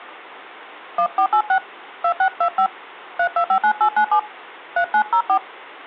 DTMF, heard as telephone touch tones, dialled by hand, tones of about 80 ms. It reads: 1486 2625 3259897 3904